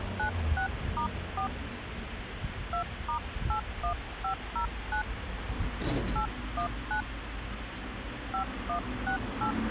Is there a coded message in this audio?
Yes: DTMF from 0.2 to 9.5 s, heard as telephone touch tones, dialled by hand, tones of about 100 ms, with phone line noise and the noise inside a lift. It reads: 96*4 2*81509 819 5168